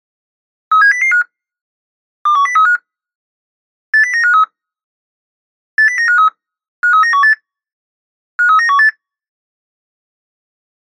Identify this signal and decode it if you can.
Five-tone selective call (CCIR), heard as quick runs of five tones, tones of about 100 ms. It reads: 37005 21035 80953 80953 53918 53918